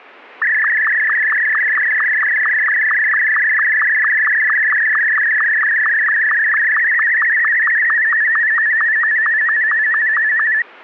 SSTV (slow-scan television), Martin M2, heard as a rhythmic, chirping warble.